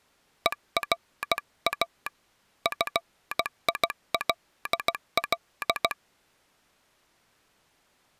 Morse code, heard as a telegraph sounder, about 16 wpm. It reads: ERA FILL